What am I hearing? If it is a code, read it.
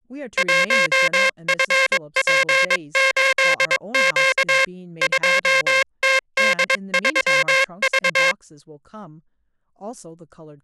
Morse code, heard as a buzzer, hand-sent with a paddle, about 22 wpm, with speech in English. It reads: 1FP8Q 2TD3V